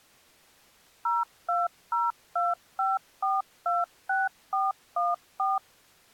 DTMF, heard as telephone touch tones, dialled by machine, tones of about 180 ms. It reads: 02025426414